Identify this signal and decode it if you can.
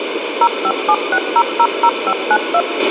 DTMF, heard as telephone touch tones, dialled by machine, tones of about 60 ms, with radio hiss and a squelch burst at the end. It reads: 0576000592